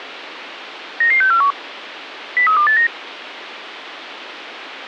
Five-tone selective call (CCIR), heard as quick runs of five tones, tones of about 100 ms, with radio hiss. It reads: 99641 03289